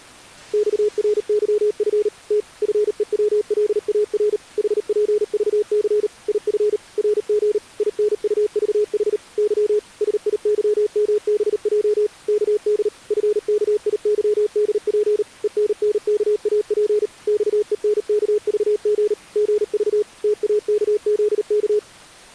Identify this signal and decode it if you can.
Morse code, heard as a keyed tone, machine-sent, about 38 wpm, 420 Hz. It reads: XRYF T FEWLAR HPVC IF RG INUVH Y SIYMBJ KD FKIYDP ENNKAP XENKVG GV TAKZK